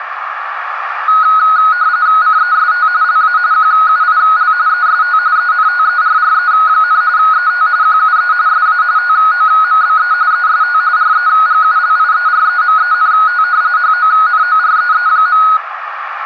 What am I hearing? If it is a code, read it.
RTTY (45.45 baud, 170 Hz shift), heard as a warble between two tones, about 1360 Hz centre, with radio static and a narrow filter. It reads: CEST LA QUIL EST ENTERRE, ET QUE SA TOMBE EST REGULIEREMENT HONOREE.